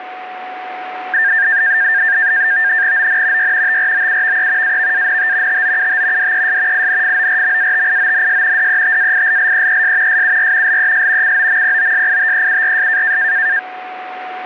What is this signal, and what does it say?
NAVTEX (SITOR-B), 100 baud, 170 Hz shift, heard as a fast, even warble, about 1700 Hz centre, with radio static and a steady whistle near 740 Hz. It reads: ON Y TROUVE AVANT TOUT DES INFORMATIONS DETAILLEES SUR LES COMPOSITEURS